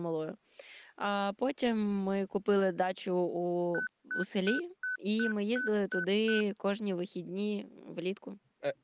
Beep code, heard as beeps from a small speaker, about 1500 Hz, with speech in Ukrainian. 8 short. In AMI BIOS tables: display memory failure; in Dell tables: LCD failure.